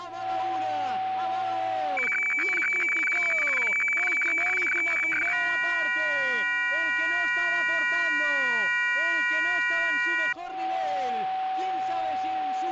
Weather fax (radiofax), 120 lines a minute, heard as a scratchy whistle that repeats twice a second, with a steady whistle near 760 Hz.